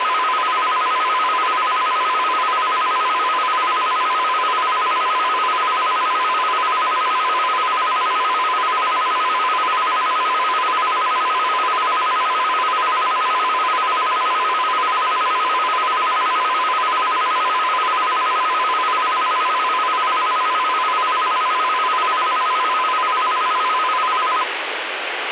A tone that alternates evenly between two pitches, with radio hiss and a squelch burst at the end. There is no code.